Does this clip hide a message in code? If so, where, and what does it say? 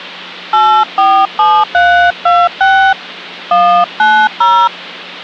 Yes: DTMF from 0.5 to 4.7 s, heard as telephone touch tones, dialled by hand, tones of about 290 ms. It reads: 847326 190